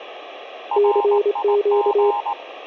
Morse code, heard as two keyed tones, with radio static and room echo. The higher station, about 19 wpm, 920 Hz: RIG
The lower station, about 25 wpm, 410 Hz: CQ